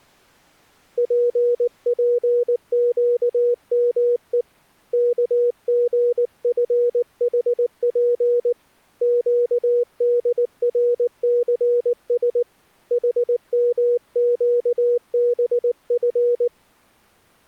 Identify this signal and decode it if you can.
Morse code (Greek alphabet), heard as a keyed tone, hand-sent with a paddle, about 19 wpm, 480 Hz. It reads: ΠΠΨΜΕ ΚΓΦΗΠ ΨΔΡΘΣ ΗΜΨΒΦ